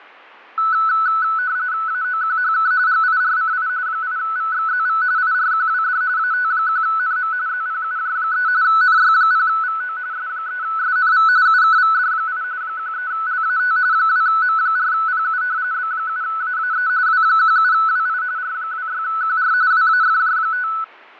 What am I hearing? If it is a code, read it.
RTTY (45.45 baud, 170 Hz shift), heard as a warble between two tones, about 1400 Hz centre, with radio static and fading. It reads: AOQHK GIRCI 8VXZV IRQWD AT1NM ZPUJ3 NY0VO S3SNV UKVD8 13LAT 2M4PU B7AAE W17WI R26QR WAFJ5